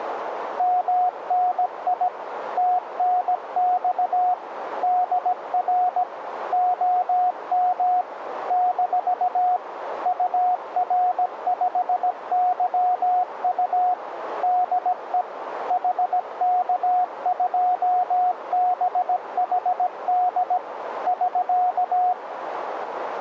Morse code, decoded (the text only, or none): MNI TNX DR OM - UR5YU DE HK2BHD <SK>